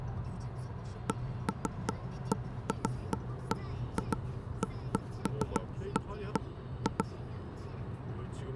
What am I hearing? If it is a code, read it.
Irregular knocks on wood, with the noise inside a car. There is no code.